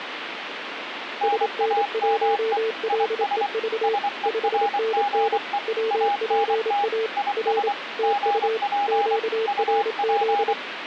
Morse code, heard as two keyed tones, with radio static. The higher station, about 24 wpm, 810 Hz: NAME IS SERGE ANT IS GP UP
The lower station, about 27 wpm, 450 Hz: SN1LEV 5NN WPA R TU QRZ